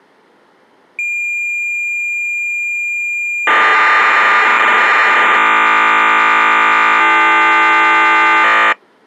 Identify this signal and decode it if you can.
Cassette data (Kansas City type), 1200 baud, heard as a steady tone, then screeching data.